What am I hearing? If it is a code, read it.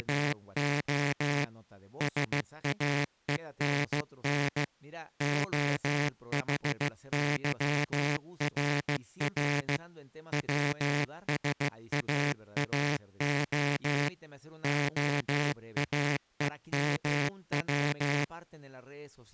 Morse code (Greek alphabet), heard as a buzzer, machine-sent, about 15 wpm, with speech in Spanish. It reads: … ΣΑΕΝΝ ΟΗΥΡΡ ΩΣΑΑΟ ΟΑΕΜΩ